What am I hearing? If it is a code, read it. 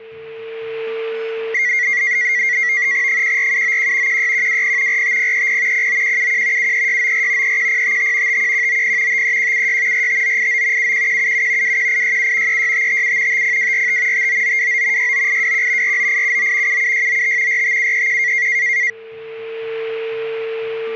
NAVTEX (SITOR-B), 100 baud, 170 Hz shift, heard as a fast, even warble, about 2050 Hz centre, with static crashes and a steady whistle near 450 Hz. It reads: 14791 16120 45030 09171 73694 31055 51190 53176 45989 71177 21867 36557 50245 59929 69821 49879 77695 45731